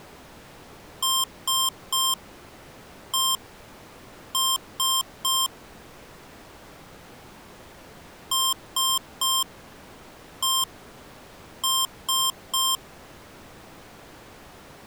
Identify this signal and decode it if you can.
Beep code, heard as beeps from a small speaker, played twice, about 1060 Hz. 3-1-3. In Phoenix BIOS tables: interrupt mask register failure.